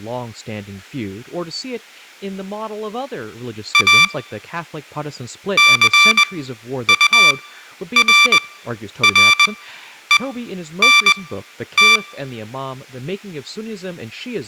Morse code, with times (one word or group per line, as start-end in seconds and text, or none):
3.7-4.0 A
5.6-12.0 CURRENT